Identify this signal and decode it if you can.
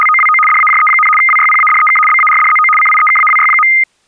RTTY (75 baud, 850 Hz shift), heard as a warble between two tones, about 1650 Hz centre. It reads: … DAJE, WYPADEK BARDZO CIEKAWY.